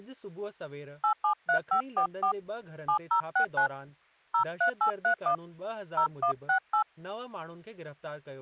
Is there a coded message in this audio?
Yes: DTMF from 1.0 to 6.8 s, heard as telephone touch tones, dialled by hand, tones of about 100 ms, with speech in Sindhi. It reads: 873544 7069 03831 0168